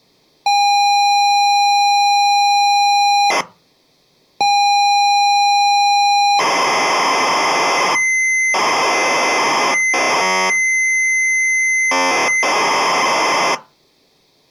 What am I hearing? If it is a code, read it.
ZX Spectrum tape loading, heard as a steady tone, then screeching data, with room echo.